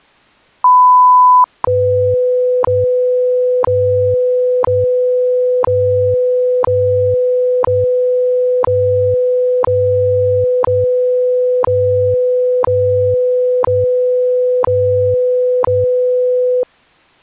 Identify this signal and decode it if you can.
Radio time signal (WWV, Colorado), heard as ticks, one a second.